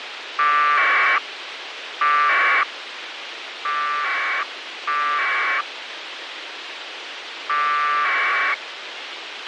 Packet radio (AX.25, as in APRS), 1200 baud, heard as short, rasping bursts, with radio hiss and a squelch burst at the end.